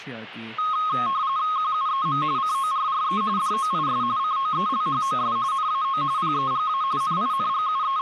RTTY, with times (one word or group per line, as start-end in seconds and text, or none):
1.6-2.2 QUEM
2.4-3.2 CORRE
3.4-4.0 DOIS
4.2-5.4 COELHOS
5.5-6.0 NAO
6.2-6.8 PEGA
7.0-8.0 …